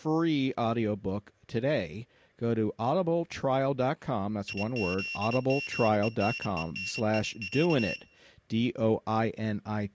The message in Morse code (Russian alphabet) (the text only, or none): ИЗМЕНЕНИЯ